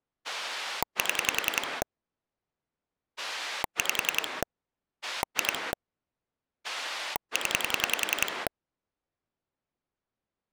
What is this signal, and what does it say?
Pulse dialling, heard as a rotary dial, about 10 pulses a second. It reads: 7 5 2 0